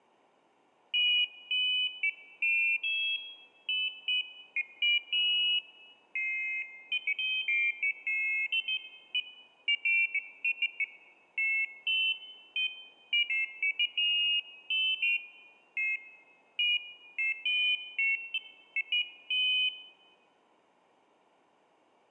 Pairs of high tones at irregular times. There is no code.